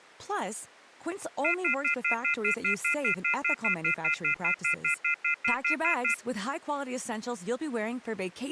Telephone call progress tone (North American plan), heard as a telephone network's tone, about 1400, 2050, 2450, 2600 Hz, 0.1 s on and 0.1 s off, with speech in French. Off-hook warning tone.